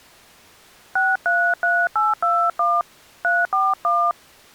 DTMF, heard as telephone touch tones, dialled by hand, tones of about 230 ms. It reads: 633821 341